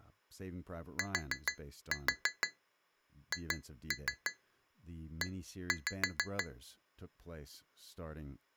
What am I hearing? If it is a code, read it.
Tap code, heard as taps on glass, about 6 knocks a second, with speech in English. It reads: THE